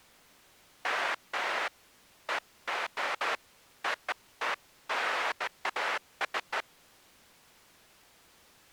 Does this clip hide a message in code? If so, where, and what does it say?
No, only bursts of noise.